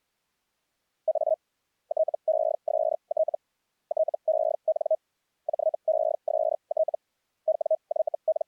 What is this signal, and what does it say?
Hellschreiber (Feld-Hell, 122.5 baud), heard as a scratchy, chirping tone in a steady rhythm, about 630 Hz. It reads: A TEST TEN JEST …